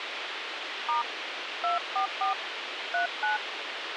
DTMF, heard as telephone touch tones, dialled by hand, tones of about 120 ms, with radio hiss. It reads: * 244 39